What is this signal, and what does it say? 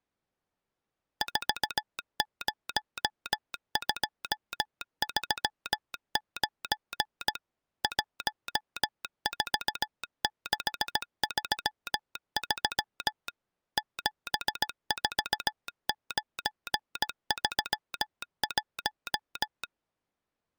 Morse code, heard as a telegraph sounder, machine-sent, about 17 wpm. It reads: 40239 14633 74931